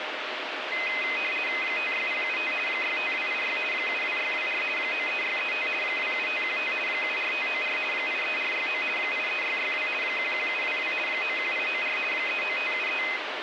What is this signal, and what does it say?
RTTY (50 baud, 450 Hz shift), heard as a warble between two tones, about 2300 Hz centre, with radio static. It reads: 56075 65286 72624 93635 27515 74594 83469 83662 11722 91894 39573